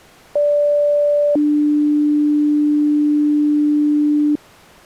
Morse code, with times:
none

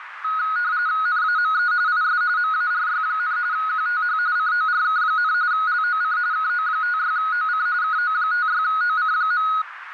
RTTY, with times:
1.1-1.7 NAME
1.9-2.2 IS
2.4-3.4 MARY,
3.5-4.2 QTH
4.4-5.3 CORK,
5.5-6.2 LOC
6.3-7.7 KO56OC
7.8-9.5 KO56OC.

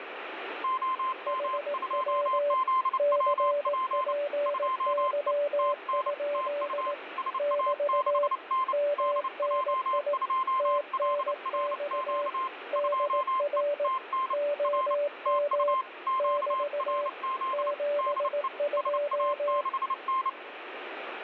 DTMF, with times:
none

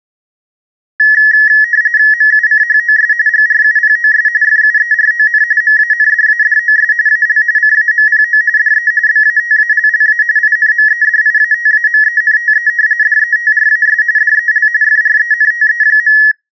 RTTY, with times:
2.1-3.1 MUCHOS
3.3-4.3 GRUPOS
4.4-5.4 FUERON
5.6-6.9 MANDADOS
7.1-7.4 AL
7.6-8.4 CAMPO
8.6-8.9 DE
9.1-10.2 BATALLA
10.4-12.7 INMEDIATAMENTE
13.0-14.0 DETRAS
14.2-14.7 DEL
14.8-16.2 FRENTE.

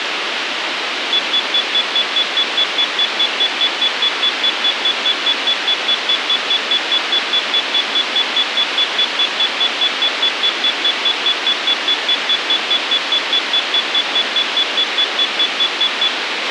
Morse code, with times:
none

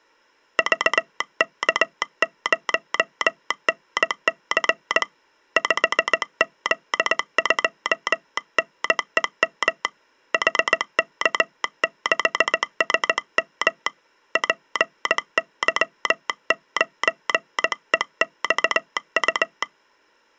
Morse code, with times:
0.6-5.0 VK0NC
5.6-9.8 5Z2NEM
10.3-13.9 HK6SM
14.4-19.6 PY9EXU

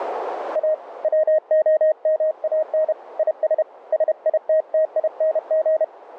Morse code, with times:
0.6-0.7 A
1.0-2.9 WOMAN
3.2-3.6 IS
3.9-5.8 SITTING

